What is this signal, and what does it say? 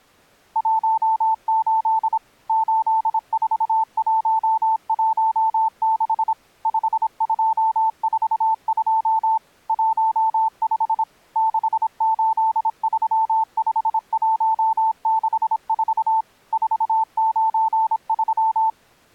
Morse code, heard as a keyed tone, machine-sent, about 26 wpm, 890 Hz. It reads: 18 84116 5242 15 6835164 493